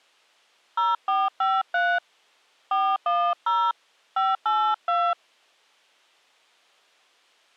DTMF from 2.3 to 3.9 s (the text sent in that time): 410